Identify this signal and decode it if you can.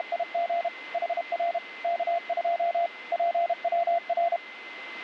Morse code, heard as a keyed tone, machine-sent, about 32 wpm, 690 Hz, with a steady whistle near 2060 Hz. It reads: … HR K2 PWR